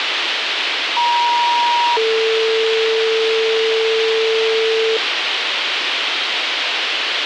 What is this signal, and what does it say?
Two-tone page, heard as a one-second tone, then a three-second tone, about 950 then 450 Hz, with radio hiss.